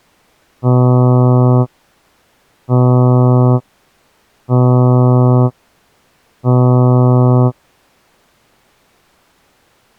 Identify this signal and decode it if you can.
Ship horn signal, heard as a ship's horn, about 120 Hz. 4 short. At sea: a pilot vessel's identity signal in fog.